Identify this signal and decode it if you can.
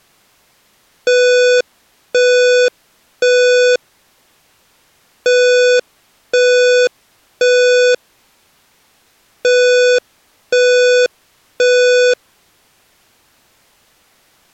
Alarm pattern, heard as an alarm's beeps, played three times, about 500 Hz. Temporal three. Smoke or fire, evacuate.